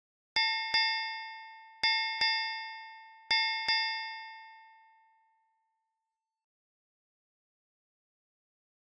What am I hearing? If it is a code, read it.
Ship's bell, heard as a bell. 6. Six half-hours of the watch have passed.